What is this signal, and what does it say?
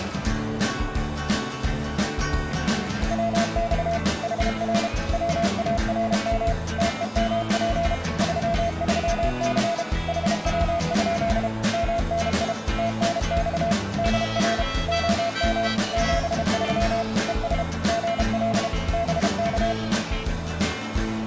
Morse code, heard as a keyed tone, machine-sent, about 32 wpm, 680 Hz, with radio static and a narrow filter. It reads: WX HR WARM TEMP 33C HW? MNI TNX DR OM 73 ES GL BK